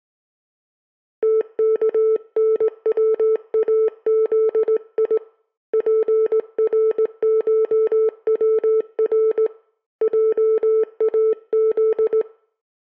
Morse code (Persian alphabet), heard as a keyed tone, hand-sent with a straight key, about 18 wpm, 440 Hz. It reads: تکنوازی پرشور جاز